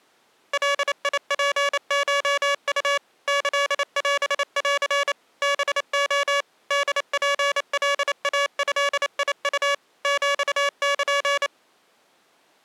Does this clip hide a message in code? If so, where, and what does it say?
Yes: Morse code (Japanese Wabun code) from 0.5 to 11.5 s, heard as electronic beeps, machine-sent, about 28 wpm, 570 Hz. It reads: ガツコウ キオン ハレ ホツカイドウ ヒル